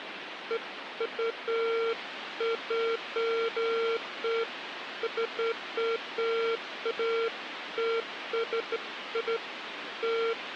Beeps of irregular length, with phone line noise. There is no code.